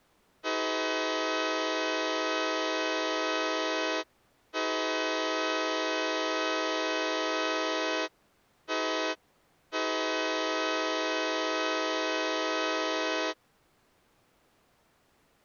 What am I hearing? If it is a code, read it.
Train horn signal, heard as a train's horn. 2 long, 1 short, 1 long. On North American railways: approaching a public crossing.